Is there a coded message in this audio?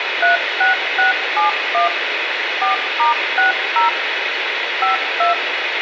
Yes: DTMF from 0.2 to 5.3 s, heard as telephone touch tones, dialled by machine, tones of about 140 ms, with radio hiss and room echo. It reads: 36671 4*60 52